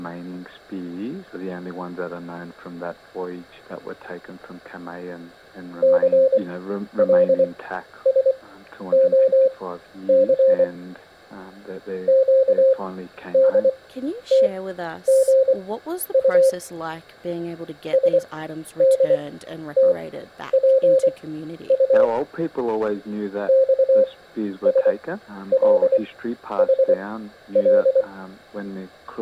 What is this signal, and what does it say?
Morse code, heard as a keyed tone, machine-sent, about 24 wpm, spaced as for 11 wpm, 530 Hz. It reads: CLSOC QDTGU SDTPU XSLHL